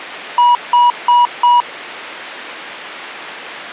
Beep code, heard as beeps, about 970 Hz. 4 short. In AMI BIOS tables: system timer failure; in Dell tables: memory read or write failure.